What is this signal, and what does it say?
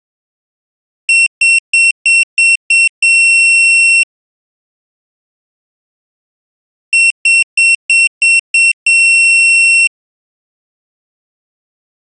Beep code, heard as a piezo beeper, played twice, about 2700 Hz. 6 short, 1 long.